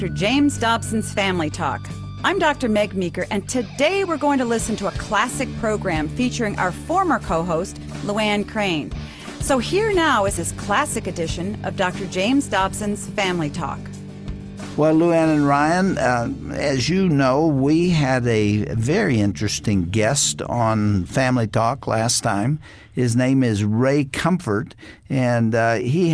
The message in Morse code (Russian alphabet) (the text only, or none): none